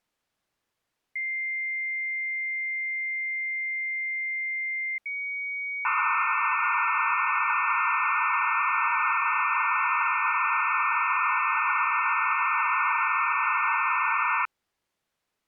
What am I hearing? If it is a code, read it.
Dial-up modem handshake (low-speed, two carriers), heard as two whistles, then hiss.